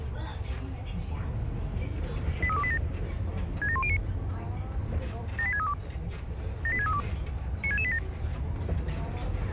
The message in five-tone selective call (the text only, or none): 83287 67109 78632 78632 96687